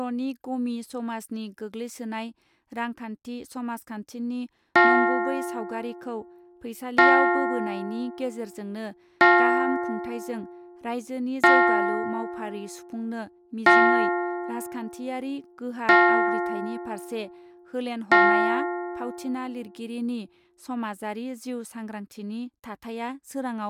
Clock strike, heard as a bell, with speech in Bodo. 7. Seven o'clock.